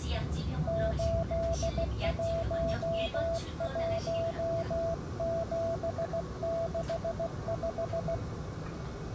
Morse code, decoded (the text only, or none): 811765